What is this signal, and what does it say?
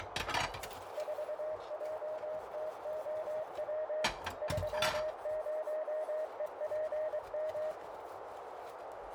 Morse code, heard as a keyed tone, machine-sent, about 23 wpm, 620 Hz, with heavy radio static, a narrow filter and kitchen noise. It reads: 4JTOW 30EPM